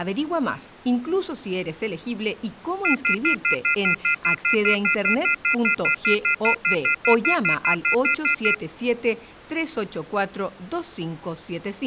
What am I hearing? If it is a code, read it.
Telephone call progress tone (North American plan), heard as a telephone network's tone, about 1400, 2050, 2450, 2600 Hz, 0.1 s on and 0.1 s off. Off-hook warning tone.